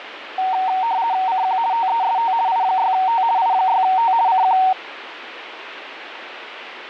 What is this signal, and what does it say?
RTTY (50 baud, 170 Hz shift), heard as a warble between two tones, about 840 Hz centre, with radio static. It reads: CQ TEST I6T I6T CQ